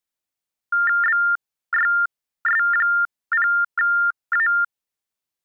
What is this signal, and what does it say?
TTY/TDD text telephone tones (45.45 baud Baudot), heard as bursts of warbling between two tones, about 400 Hz shift, 1600 Hz centre. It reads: BYS0A